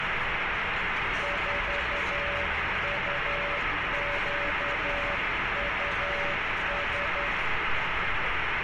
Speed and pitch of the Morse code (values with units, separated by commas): 11 wpm, 570 Hz